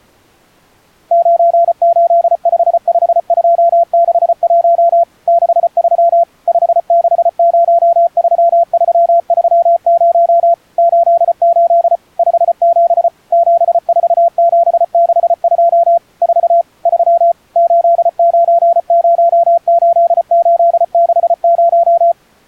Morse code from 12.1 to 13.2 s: 57

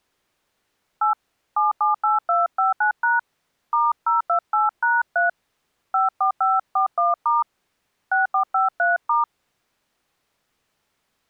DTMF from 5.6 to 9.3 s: 54541* 6453*

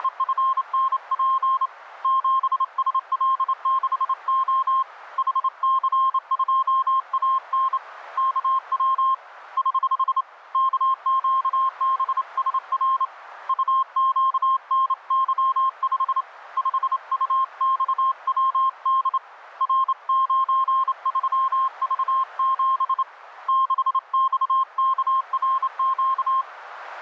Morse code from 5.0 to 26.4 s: HC2AN KW <HH> KQBSR UQNY5 5UXWD R93V7 6XKRQ

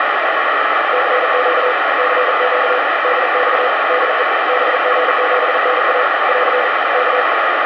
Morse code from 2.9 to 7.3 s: DX DE BG7NA <AR> K

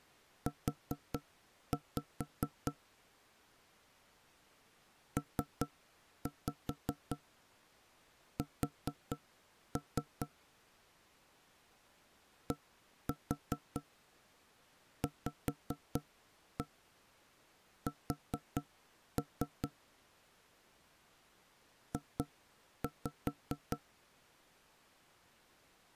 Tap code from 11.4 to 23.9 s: DVS J

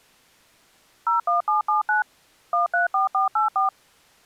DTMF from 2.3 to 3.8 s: 134484

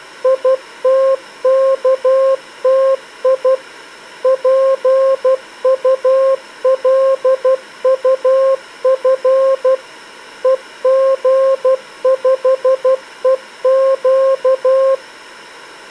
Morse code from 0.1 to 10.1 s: ITKTI PULUF

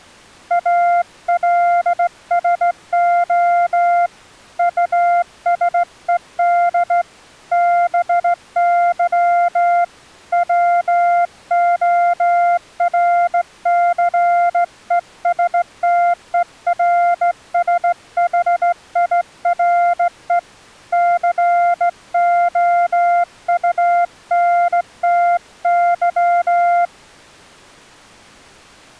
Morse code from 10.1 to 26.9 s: WORCESTERSHIRE COUNTY

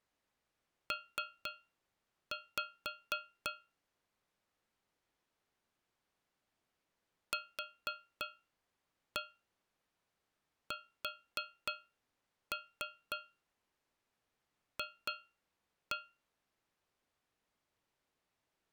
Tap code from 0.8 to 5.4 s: P

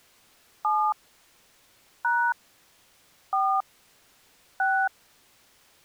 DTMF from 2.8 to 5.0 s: 4 6

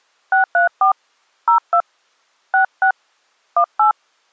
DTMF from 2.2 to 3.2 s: 66

